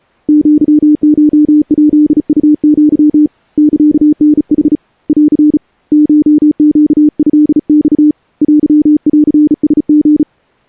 Morse code (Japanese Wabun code), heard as a keyed tone, hand-sent with a bug key, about 35 wpm, 300 Hz. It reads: アコヱウア サタヌ ン コネトマ テンラリ